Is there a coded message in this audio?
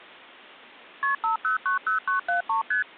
Yes: multi-frequency trunk signalling (R1, as on North American trunks) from 1.0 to 2.8 s, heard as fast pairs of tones, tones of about 120 ms. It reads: KP 5090973 ST